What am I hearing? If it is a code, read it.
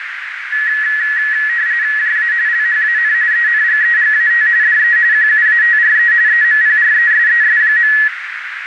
RTTY (45.45 baud, 170 Hz shift), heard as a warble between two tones, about 1800 Hz centre, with radio static and a narrow filter. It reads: JA LHAN ENGEGAT DE QUATRE EMPRESES.